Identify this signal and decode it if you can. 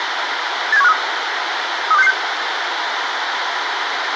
Five-tone selective call (EEA), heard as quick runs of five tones, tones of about 40 ms, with radio hiss and a squelch burst at the end. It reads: 87153 32666